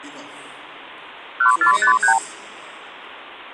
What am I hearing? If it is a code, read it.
Multi-frequency trunk signalling (R2, with the far end's replies), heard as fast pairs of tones, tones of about 100 ms. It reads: 1453